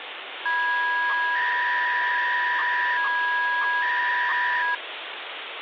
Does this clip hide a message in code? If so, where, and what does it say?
Yes: 300-baud modem data (V.21 tones) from 0.5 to 4.8 s, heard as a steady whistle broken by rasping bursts, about 300 baud, 200 Hz shift, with phone line noise.